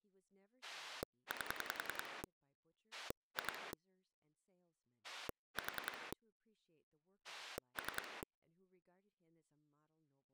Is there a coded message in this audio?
Yes: pulse dialling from 0.6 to 8.2 s, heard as a rotary dial, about 10 pulses a second, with speech in English. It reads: 8 2 4 3